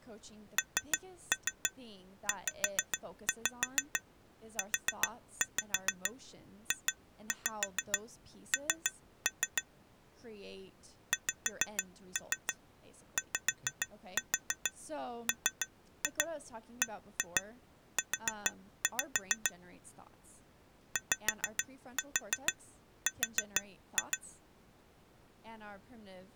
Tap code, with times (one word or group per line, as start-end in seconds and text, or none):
0.6-9.6 NZUJN
11.1-19.5 XYMBU
21.0-24.2 YR